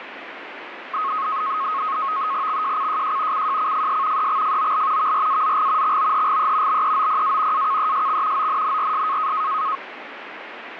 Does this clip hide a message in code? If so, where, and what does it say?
Yes: NAVTEX (SITOR-B), 100 baud, 170 Hz shift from 0.9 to 9.8 s, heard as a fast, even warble, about 1180 Hz centre, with radio static. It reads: XJCJJ CJCFS EXFOL VRAZG XOHGE BEOPA AKESX ONNRS